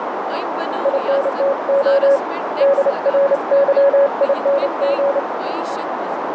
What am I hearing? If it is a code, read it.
Morse code, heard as a keyed tone, hand-sent with a paddle, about 29 wpm, 560 Hz, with heavy radio static, a narrow filter and speech in Kashmiri. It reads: INTO DRYING